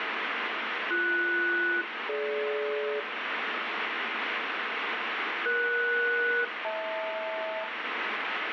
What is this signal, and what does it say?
Aircraft SELCAL, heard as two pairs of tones, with radio static. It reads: BS-DG ES-HL